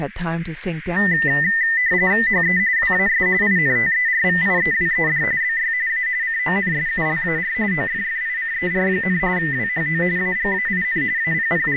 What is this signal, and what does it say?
RTTY (45.45 baud, 170 Hz shift), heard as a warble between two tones, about 1900 Hz centre, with radio static, a narrow filter and speech in English. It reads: HE WAS INTERVIEWED BY A CONSULAR OFFICER, WHO AGAIN …